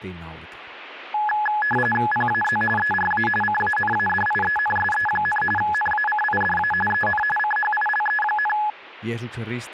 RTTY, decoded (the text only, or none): PAZ ERA CANADIENSE, NACIDA EN CHILE,